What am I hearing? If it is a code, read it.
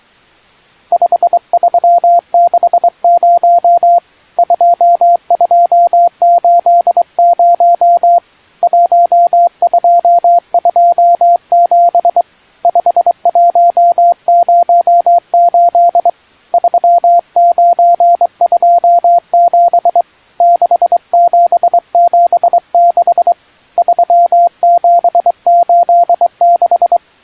Morse code, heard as a keyed tone, hand-sent with a straight key, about 23 wpm, 690 Hz. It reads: 5360 2280 1227 5108 3927 6776 3786